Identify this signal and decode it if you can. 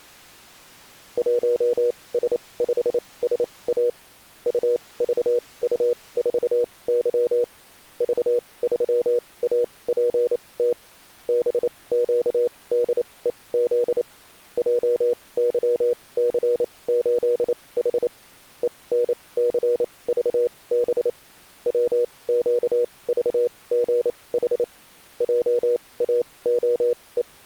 Morse code, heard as a keyed tone, machine-sent, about 28 wpm, spaced as for 21 wpm, 480 Hz. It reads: 1S5SA UVU4Y V3APT BQDEZ JYC8H ENCVB WQVGH …